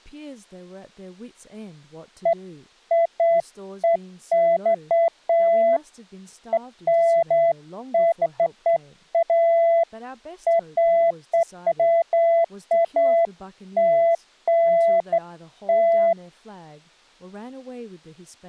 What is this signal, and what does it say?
Beeps of irregular length, with speech in English. There is no code.